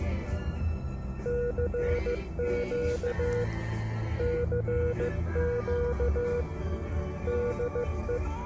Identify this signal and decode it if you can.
Morse code, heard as a keyed tone, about 15 wpm, 480 Hz, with radio static and the noise inside a car. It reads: CQ CQ DE